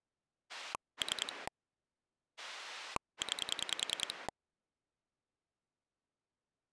Pulse dialling, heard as a rotary dial, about 10 pulses a second. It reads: 3 9